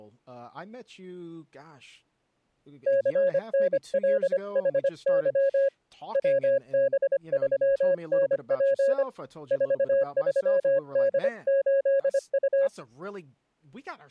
Morse code, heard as a keyed tone, hand-sent with a paddle, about 25 wpm, 550 Hz, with speech in English. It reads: CNLHY WB3NP 43D8U